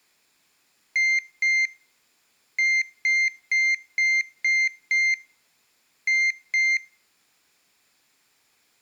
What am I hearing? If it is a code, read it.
Beep code, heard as a piezo beeper, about 2100 Hz. 2-6-2.